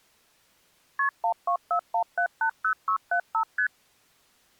Multi-frequency trunk signalling (R1, as on North American trunks), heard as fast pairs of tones, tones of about 90 ms. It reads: KP 1241780675 ST